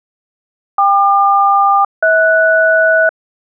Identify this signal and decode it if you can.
Aircraft SELCAL, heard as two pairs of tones. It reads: KQ-HS